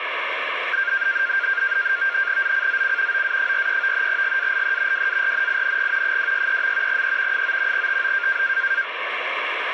NAVTEX (SITOR-B), 100 baud, 170 Hz shift, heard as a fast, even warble, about 1500 Hz centre, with radio static. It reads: ZCZC OA43 GALE WARNING 263. E 9 TO